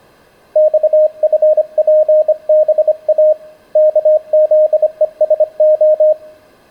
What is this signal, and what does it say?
Morse code, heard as a keyed tone, hand-sent with a bug key, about 25 wpm, 620 Hz. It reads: XFPBA KZESO